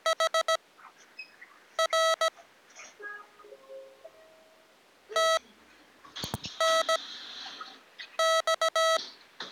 Morse code, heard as electronic beeps, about 17 wpm, spaced as for 6 wpm, 650 Hz, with the noise inside a lift. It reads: HR TNX